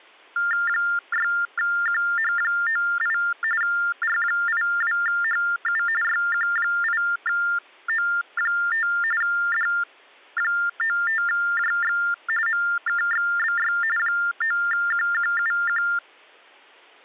TTY/TDD text telephone tones (45.45 baud Baudot), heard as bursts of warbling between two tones, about 400 Hz shift, 1600 Hz centre. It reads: 6QH98 R82HU YQ8O5 D95JX MKXBY 9QQUQ